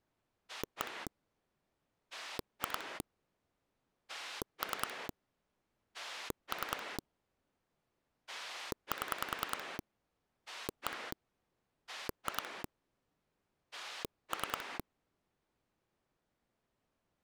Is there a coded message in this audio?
Yes: pulse dialling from 0.5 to 14.8 s, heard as a rotary dial, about 10 pulses a second. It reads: 1 2 3 3 7 1 2 3